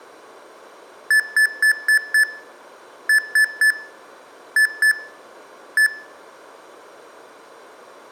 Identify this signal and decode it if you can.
Beep code, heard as beeps from a small speaker, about 1750 Hz, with room echo. 5-3-2-1.